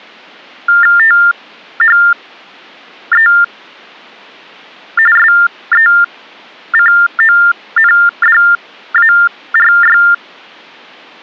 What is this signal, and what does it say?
TTY/TDD text telephone tones (45.45 baud Baudot), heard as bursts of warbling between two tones, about 400 Hz shift, 1600 Hz centre. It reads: THE SECONDARY